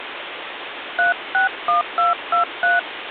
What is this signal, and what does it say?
DTMF, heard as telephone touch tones, dialled by hand, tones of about 130 ms, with phone line noise. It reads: 361223